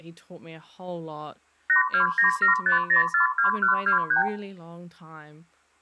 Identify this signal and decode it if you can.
Multi-frequency trunk signalling (R2, with the far end's replies), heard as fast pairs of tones, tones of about 120 ms, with speech in English. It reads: 82975042123